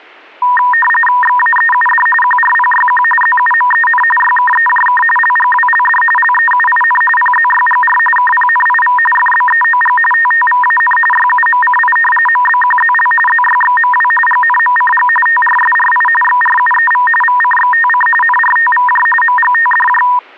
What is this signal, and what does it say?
RTTY (45.45 baud, 850 Hz shift), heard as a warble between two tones, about 1410 Hz centre. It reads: XAEUD QRPYQ ZUMEN YKEJK LGWLD LEUIN PZYGR KPNIV FBEOG TTVAN YUMCI MBQZL ZYXMW GNMCG TRSRI XRUEV VCXTC NRTVJ MGTDJ